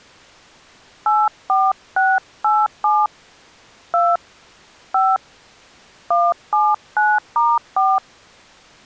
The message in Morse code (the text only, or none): none